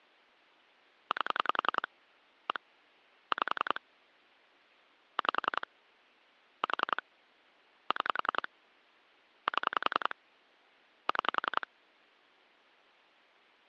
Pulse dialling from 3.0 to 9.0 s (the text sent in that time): 5 5 4 6